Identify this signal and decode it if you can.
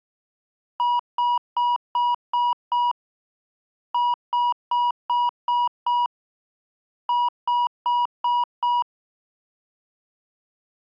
Beep code, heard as beeps, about 970 Hz. 6-6-5.